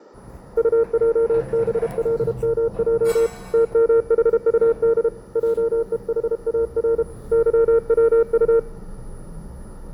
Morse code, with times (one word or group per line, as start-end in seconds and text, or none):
0.6-3.3 UJBLMJ
3.5-5.1 TMHUD
5.4-7.0 JEHAR
7.3-8.6 YWU